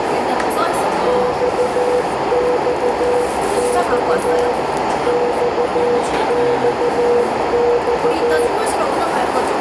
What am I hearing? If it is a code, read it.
Morse code, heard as a keyed tone, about 14 wpm, 490 Hz, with heavy radio static, a narrow filter and the noise of a cafe. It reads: XXX XXX